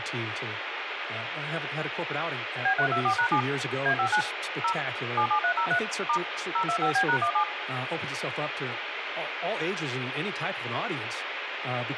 DTMF, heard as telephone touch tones, dialled by machine, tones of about 90 ms, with phone line noise, room echo and speech in English. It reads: B324#7 A59 0 77303 * 025B#17